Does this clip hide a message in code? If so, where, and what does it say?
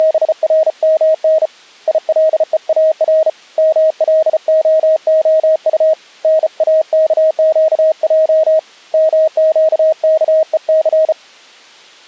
Yes: Morse code (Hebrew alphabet) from 0.0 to 11.2 s, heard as a keyed tone, hand-sent with a bug key, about 34 wpm, 630 Hz. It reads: … ילואר מלההט נאכקע מקכוס